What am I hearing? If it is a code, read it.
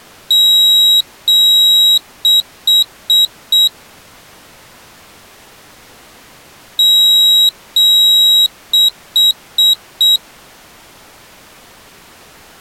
Beep code, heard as a piezo beeper, played twice, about 3850 Hz. 2 long, 4 short.